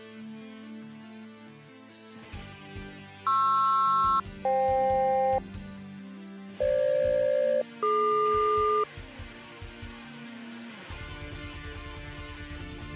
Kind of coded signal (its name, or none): aircraft SELCAL